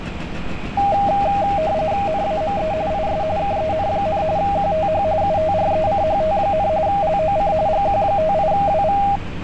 RTTY (45.45 baud, 170 Hz shift), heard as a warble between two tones, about 720 Hz centre, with street noise. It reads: NAME IS KEN, QTH UTRECHT, LOC GQ58WV